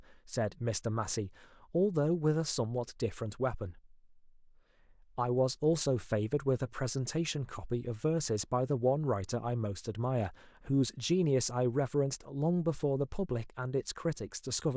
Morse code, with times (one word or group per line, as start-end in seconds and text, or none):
none